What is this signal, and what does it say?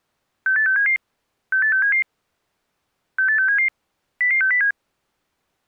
Five-tone selective call (CCIR), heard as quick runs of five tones, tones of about 100 ms. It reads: 68677 68677 68677 00607